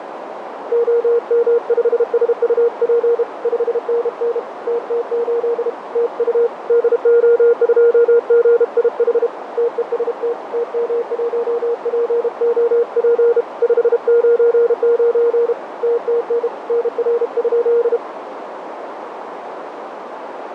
Morse code, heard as a keyed tone, hand-sent with a bug key, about 32 wpm, 470 Hz, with radio static, fading and a narrow filter. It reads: OM5SUP 5NN TT8 TU DO2GIH TEST TM1POP 599 TTN NR?